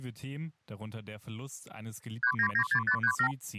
Multi-frequency trunk signalling (R2, with the far end's replies), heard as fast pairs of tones, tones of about 80 ms. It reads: 3996537